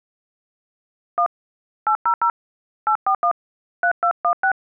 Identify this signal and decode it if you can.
DTMF, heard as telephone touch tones, dialled by hand, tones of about 80 ms. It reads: 1 800 841 3216